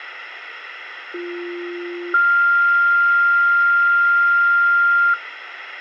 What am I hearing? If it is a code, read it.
Two-tone page, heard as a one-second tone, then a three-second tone, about 350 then 1400 Hz, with radio hiss and room echo.